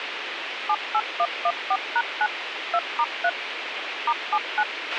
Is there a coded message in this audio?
Yes: DTMF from 0.7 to 4.6 s, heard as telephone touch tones, dialled by machine, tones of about 60 ms, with radio hiss and a squelch burst at the end. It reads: 78114#9 2*3 *79